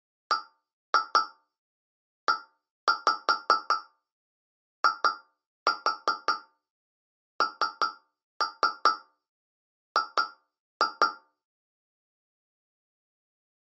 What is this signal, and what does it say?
Tap code, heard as taps on a metal pipe, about 5 knocks a second. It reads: BEING